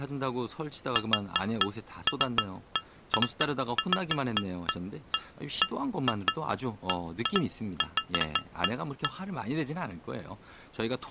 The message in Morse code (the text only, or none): none